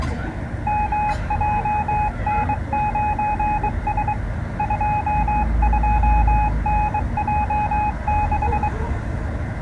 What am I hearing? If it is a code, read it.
Morse code, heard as a keyed tone, hand-sent with a bug key, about 23 wpm, 840 Hz, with the noise of a residential street. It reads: MJN9S 22NJ6